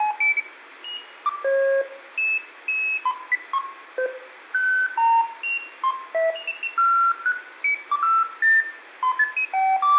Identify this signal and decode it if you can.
Electronic bleeps of random pitch and length, with phone line noise and room echo. There is no code.